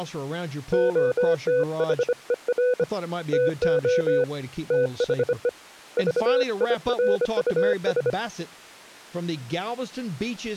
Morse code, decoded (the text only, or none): OTHER TO THE VIRUS